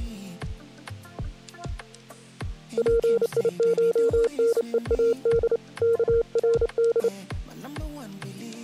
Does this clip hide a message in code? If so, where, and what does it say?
Yes: Morse code (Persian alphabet) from 2.7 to 7.1 s, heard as a keyed tone, hand-sent with a paddle, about 29 wpm, 460 Hz. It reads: پیشنهاد کرد